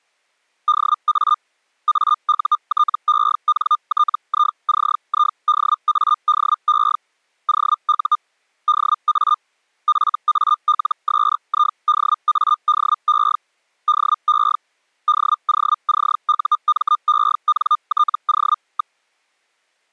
Hellschreiber (Feld-Hell, 122.5 baud), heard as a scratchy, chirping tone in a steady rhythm, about 1210 Hz. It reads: DA AUTENTICIDADE OU DA FALSIDADE DE DOCUMENTO.